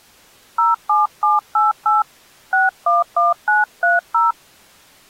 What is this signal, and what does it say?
DTMF, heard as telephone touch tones, dialled by hand, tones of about 160 ms. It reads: 07788 611930